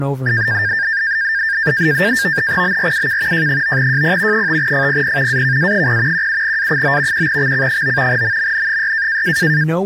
NAVTEX (SITOR-B), 100 baud, 170 Hz shift, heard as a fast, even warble, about 1700 Hz centre, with speech in English. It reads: BRUK J9JP 5FPP AKA0 17A9 1XC9 MMN6